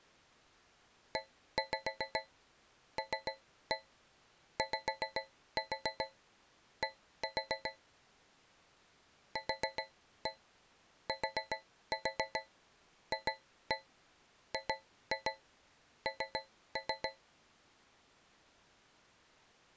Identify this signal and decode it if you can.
Tap code, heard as taps on a metal pipe, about 7 knocks a second. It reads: ELYD QTFGN